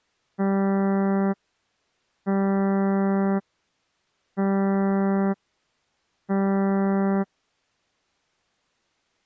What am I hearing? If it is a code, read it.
Ship horn signal, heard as a ship's horn, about 200 Hz. 4 short. At sea: a pilot vessel's identity signal in fog.